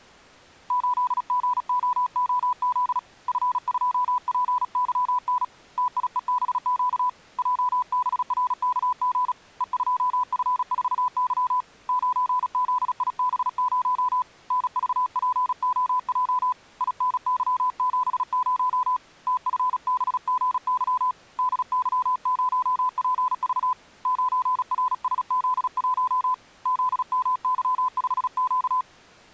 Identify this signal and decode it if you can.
Morse code, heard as a keyed tone, hand-sent with a paddle, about 36 wpm, 1000 Hz. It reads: 8GOOZ F2PYN TIEBQ JBRKG E2F4Y 9ZIB0 NVPOJ INY70 TFBGY DY0PV 9RSZ1 ZMY5Q